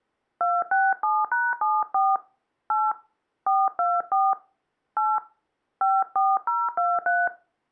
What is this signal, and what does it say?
DTMF, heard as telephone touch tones, dialled by hand, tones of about 220 ms. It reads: 267#74 8 424 8 54023